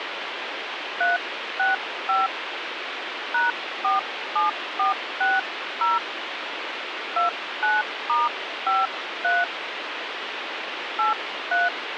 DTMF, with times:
1.0-2.3 365
3.3-6.0 #47460
7.2-9.4 29*53
11.0-11.7 83

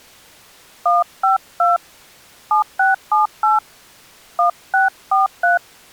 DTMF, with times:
0.9-1.8 152
2.5-3.6 7678
4.4-5.6 1643

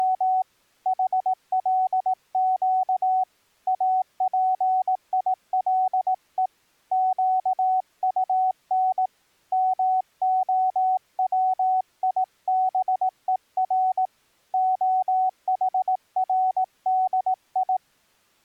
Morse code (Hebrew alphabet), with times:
0.0-0.4 …
0.9-3.2 חלק
3.7-6.5 אפילו
6.9-9.1 קטן
9.5-14.1 מהציבור
14.5-17.8 החרדי

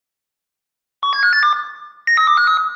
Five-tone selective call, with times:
1.0-1.5 17582
2.1-2.6 93253

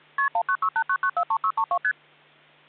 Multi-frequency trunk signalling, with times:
0.2-0.3 KP
0.3-1.8 19689943632
1.8-1.9 ST

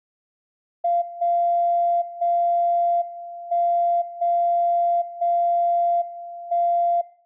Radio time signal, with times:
1.0-2.0 0
2.0-3.0 0
3.0-4.0 1
4.0-5.0 0
5.0-6.0 0
6.0-7.0 1

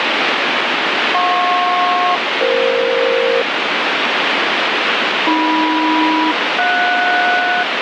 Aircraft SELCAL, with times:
1.1-3.4 JP-EF
5.3-7.6 AM-JS

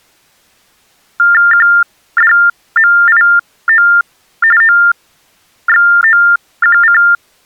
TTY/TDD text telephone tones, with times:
1.5-3.9 QDMIO
4.6-7.0 OXOQC

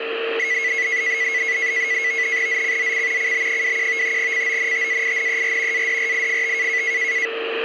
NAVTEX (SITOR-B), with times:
2.5-3.3 ZCZC
3.2-4.2 CB21
4.2-5.9 CONTAINER
5.7-6.8 ADRIFT

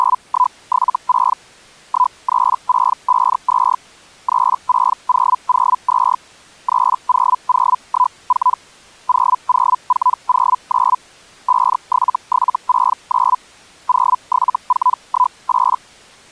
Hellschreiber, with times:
0.0-1.4 …
1.9-3.8 13652
4.3-6.2 36002
6.7-8.6 30014
9.1-11.0 00409
11.5-13.4 57769
13.9-15.8 07418

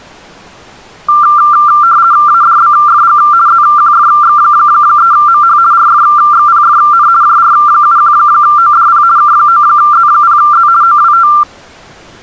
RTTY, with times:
2.3-3.2 ADBFG
3.5-5.6 ZQFX3MH
5.7-7.1 RFXPFN
7.2-9.0 JR71ODP
9.2-10.7 K9Z0Z
10.8-11.3 OWT

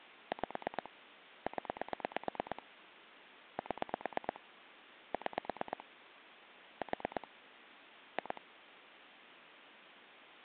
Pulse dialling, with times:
0.3-0.9 5
1.5-2.6 0
3.6-4.4 7
5.1-5.8 6
6.8-7.3 4
8.2-8.4 2

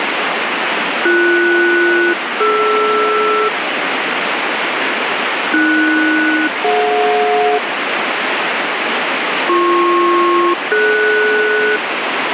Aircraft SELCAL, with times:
1.1-3.5 BS-DR
5.5-7.6 AS-DJ
9.5-11.8 BP-DS

